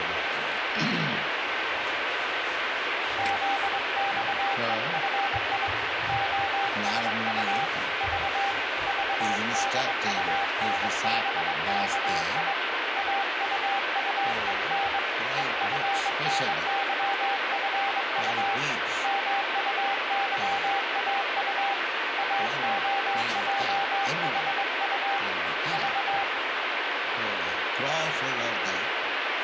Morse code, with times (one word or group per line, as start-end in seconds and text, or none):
3.2-5.7 ZXEFI
6.1-7.7 OSU
8.0-8.5 V
8.9-12.5 VDUNBKI
13.0-15.0 AUUEN
15.4-18.6 EFNYFU
19.0-21.7 MUYAU
22.2-25.2 AOJHU
25.7-26.2 V